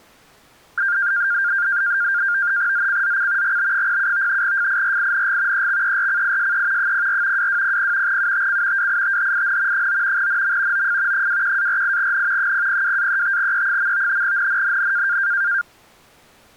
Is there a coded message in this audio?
Yes: NAVTEX (SITOR-B), 100 baud, 170 Hz shift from 0.8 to 15.6 s, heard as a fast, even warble, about 1500 Hz centre. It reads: ZCZC GB07 FIRING EXERCISE 04 2200 UTC WITHIN 9 NM OF 21-48N 002-35E. NNNN